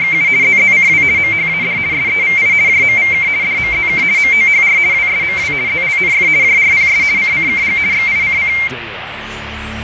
RTTY (50 baud, 170 Hz shift), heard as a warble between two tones, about 2200 Hz centre, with radio static and fading. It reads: … ZZCW MHAD SEVI JMVK DMZK MOHR WSMW ZLNF JRPS CCKG XICC